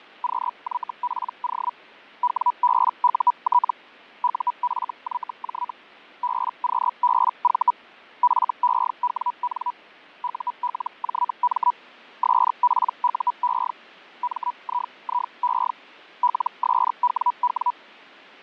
Hellschreiber (Feld-Hell, 122.5 baud), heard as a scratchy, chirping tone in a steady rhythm, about 980 Hz, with fading. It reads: QYPO WBUT UFYJ BQBV FEWN ULJM SPUE MIIE LSWW